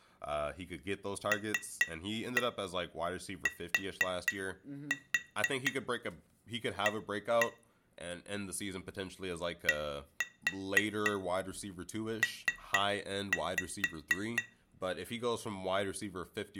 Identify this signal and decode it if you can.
Tap code, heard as taps on glass, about 4 knocks a second, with room echo and speech in English. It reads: LTA DP